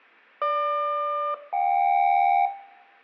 Aircraft SELCAL, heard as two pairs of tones, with room echo. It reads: GQ-JK